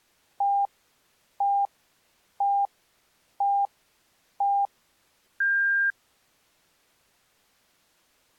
Radio time signal (five pips and a higher one, as on Chinese radio), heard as pips.